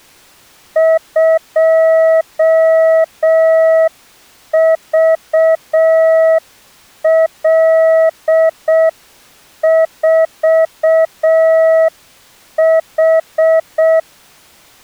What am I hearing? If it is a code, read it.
Morse code, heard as a keyed tone, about 6 wpm, 650 Hz. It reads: 2VL4H